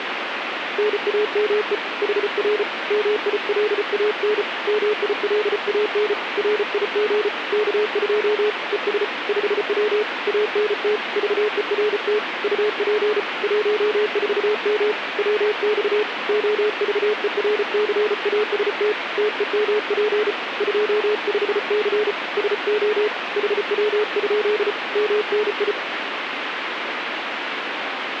Morse code, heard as a keyed tone, hand-sent with a paddle, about 34 wpm, 420 Hz, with radio static. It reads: NAME HR MILAN MILAN RIG K2 ES 5W ANT VERT UP 14M WX OVERCAST TEMP 25C SO HW? MNI